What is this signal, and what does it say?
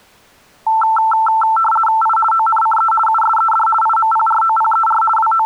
RTTY (50 baud, 450 Hz shift), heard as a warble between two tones, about 1110 Hz centre. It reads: I ONCE USED IMPROPER …